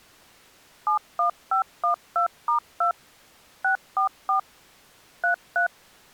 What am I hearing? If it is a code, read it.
DTMF, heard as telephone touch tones, dialled by machine, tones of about 110 ms. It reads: 71512*2 644 33